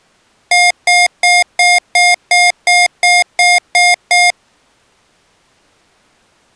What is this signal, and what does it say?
Beep code, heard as beeps from a small speaker, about 710 Hz. 11 short. In AMI BIOS tables: cache memory error.